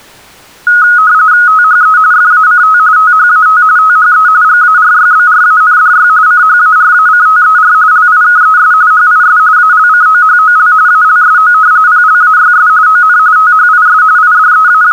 RTTY (45.45 baud, 170 Hz shift), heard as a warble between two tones, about 1360 Hz centre. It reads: THE FACT THAT THE GARYBRANDY CHARACTER LIKES HIS ALCOHOL ALSO PLAYS ON THIS …